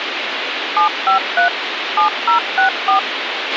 DTMF, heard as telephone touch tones, dialled by machine, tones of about 110 ms, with radio hiss and a squelch burst at the end. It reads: 753 7064